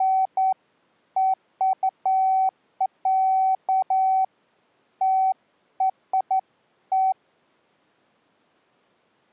Beeps of irregular length. There is no code.